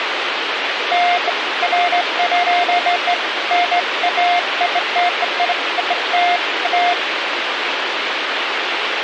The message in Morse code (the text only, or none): none